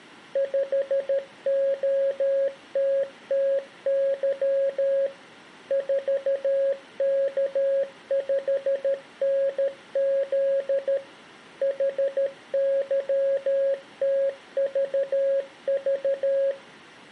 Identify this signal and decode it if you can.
Morse code, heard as a keyed tone, machine-sent, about 13 wpm, 550 Hz, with room echo. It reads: 5OTTY 4K5NZ HYTVV